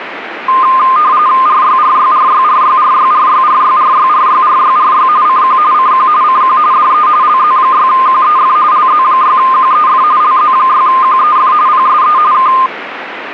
RTTY (45.45 baud, 170 Hz shift), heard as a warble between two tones, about 1130 Hz centre, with radio static. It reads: RYRYRYRYRYRYRYRYRYRYRY CQ CQ CQ DE LZ6QEF LZ6QEF LZ6QEF PSE K